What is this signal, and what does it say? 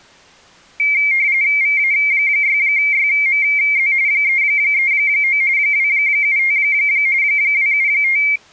RTTY (45.45 baud, 170 Hz shift), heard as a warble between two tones, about 2200 Hz centre. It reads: VA6YMZ 339 275 275